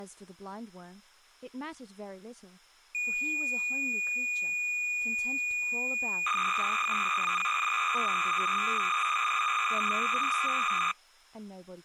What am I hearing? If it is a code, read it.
Cassette data (Kansas City type), 300 baud, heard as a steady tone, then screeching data, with speech in English.